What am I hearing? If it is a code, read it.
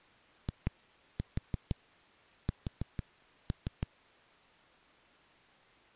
Tap code, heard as knocks on a wall, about 6 knocks a second. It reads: IS